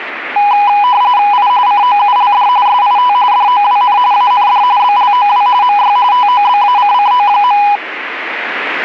RTTY (45.45 baud, 170 Hz shift), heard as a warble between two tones, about 910 Hz centre. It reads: I COULD SIT DOWN AND BLOW MY TOBACCO.